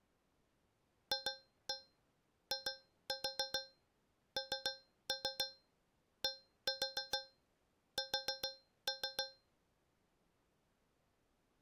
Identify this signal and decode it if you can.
Tap code, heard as taps on a metal pipe, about 7 knocks a second. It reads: FINDS